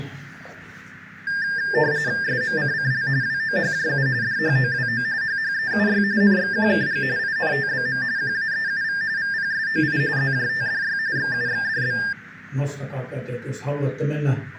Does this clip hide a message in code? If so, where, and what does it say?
Yes: RTTY (45.45 baud, 170 Hz shift) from 1.3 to 12.1 s, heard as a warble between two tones, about 1700 Hz centre, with radio static. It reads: SMCCL WOHJU DHOWO HHEUY NXQKG INTBM QAEUV VPSOI ZJTDY XUXDB